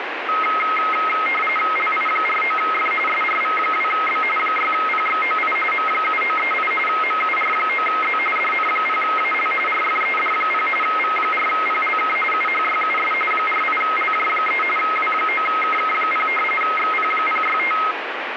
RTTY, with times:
1.8-2.9 LI49F
3.1-4.2 SRV2B
4.4-5.6 6PXOI
5.7-6.7 M7938
6.9-8.2 MUR9Z
8.4-9.5 DN0AL
9.7-10.7 RFED0
10.8-12.2 V4PLK
12.3-13.1 UHYUS
13.3-14.6 48LJ3
14.8-16.3 W9KK0
16.6-17.8 XP065

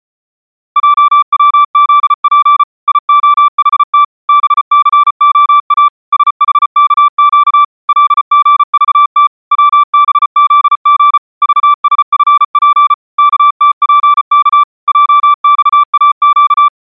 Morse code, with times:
0.8-2.6 JWZP
2.9-4.0 IOHT
4.3-5.9 BCOA
6.1-7.6 SHKQ
7.9-9.3 LGVT
9.5-11.2 WBZG
11.4-12.9 VSFP
13.2-14.6 KTPK
14.9-16.7 JXAQ

